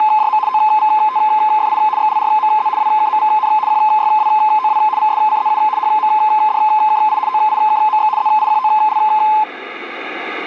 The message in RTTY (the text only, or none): … OVTFI XLRMZ WKMVN QYWOW VSCZU HMDKI OIKMX ZIQOL